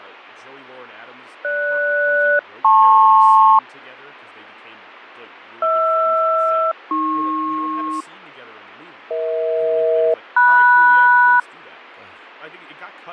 Aircraft SELCAL, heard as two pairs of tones, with radio static, fading and speech in English. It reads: GS-LP HR-AP EH-MS